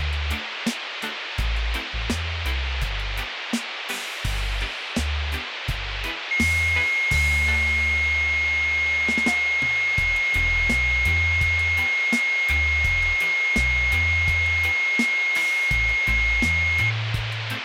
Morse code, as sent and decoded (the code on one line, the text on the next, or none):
none